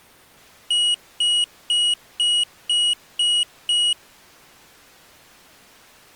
Beep code, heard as a piezo beeper, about 2900 Hz. 7 short. In AMI BIOS tables: virtual mode exception error; in Dell tables: processor failure.